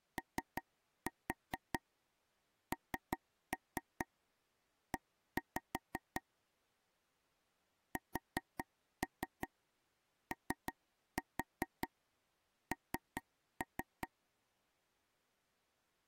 Tap code, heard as taps on a table, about 5 knocks a second. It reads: ONE SON